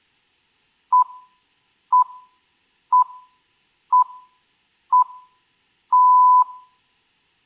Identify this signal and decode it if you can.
Radio time signal (six pips, as the Greenwich Time Signal), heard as pips, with room echo.